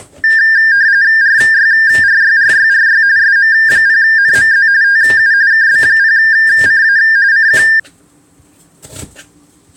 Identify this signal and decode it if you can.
RTTY (45.45 baud, 170 Hz shift), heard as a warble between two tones, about 1700 Hz centre, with kitchen noise. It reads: RYRYRYRY SM0NMZ TU KB0CA CQ